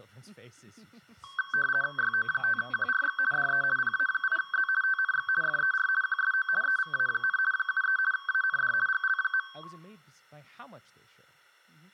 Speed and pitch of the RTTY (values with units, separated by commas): 50 baud, 450 Hz shift, 1320 Hz centre